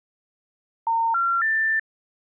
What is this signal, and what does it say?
Telephone call progress tone (North American plan), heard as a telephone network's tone, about 910, 1370, 1800 Hz. Special information tone.